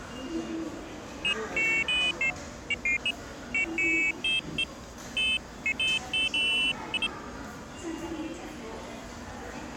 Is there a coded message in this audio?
No, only pairs of high tones at irregular times, with the noise of a subway station.